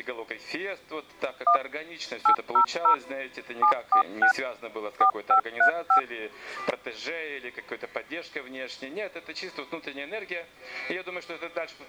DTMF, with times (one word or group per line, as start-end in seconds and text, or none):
1.5-1.6 1
2.3-2.9 800
3.6-4.3 746
5.0-6.0 4535